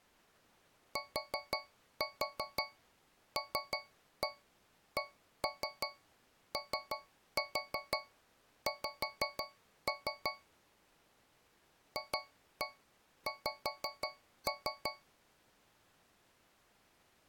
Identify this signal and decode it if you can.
Tap code, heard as taps on a metal pipe, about 5 knocks a second. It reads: TLCOX FX